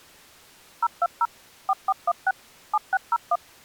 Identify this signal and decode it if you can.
DTMF, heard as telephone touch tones, dialled by machine, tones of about 40 ms. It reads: 020 4416 7601